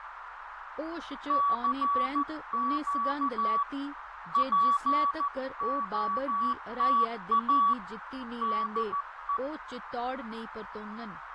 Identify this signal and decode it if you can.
Morse code, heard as a keyed tone, hand-sent with a paddle, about 14 wpm, 1140 Hz, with radio static, fading, a narrow filter and speech in Dogri. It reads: CQ POTA DE